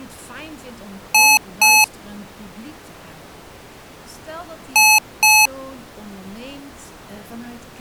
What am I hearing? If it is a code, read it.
Beep code, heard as beeps from a small speaker, played twice, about 860 Hz, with speech in Dutch. 2 short. In AMI BIOS tables: memory parity error; in IBM BIOS tables: self-test error shown on screen; in Dell tables: no memory detected.